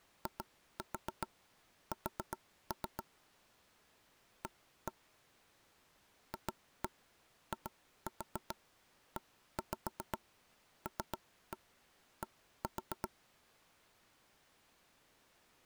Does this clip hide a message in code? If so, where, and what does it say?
Yes: tap code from 0.3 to 13.1 s, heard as knocks on wood, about 7 knocks a second. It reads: IS A FIELD